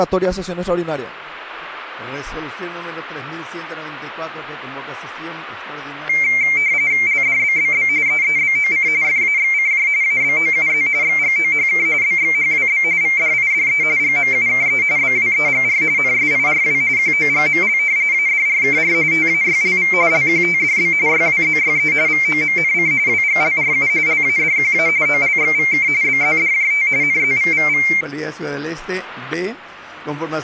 RTTY (45.45 baud, 170 Hz shift), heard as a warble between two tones, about 2200 Hz centre, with static crashes. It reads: LDBBB EEBOC FAXCJ ABOUZ XGOHK BXHWB VDIDE GMUKE BWEGR NSIRW QOGML ADRKR TAYLV LQTDB YWZYE VOMNC WGLRU LADQA OLXVK BZDJT NZVVV